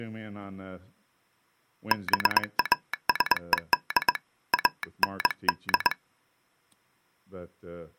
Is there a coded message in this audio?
Yes: Morse code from 1.9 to 6.0 s, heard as a telegraph sounder, hand-sent with a straight key, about 21 wpm, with speech in English. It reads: BASED AND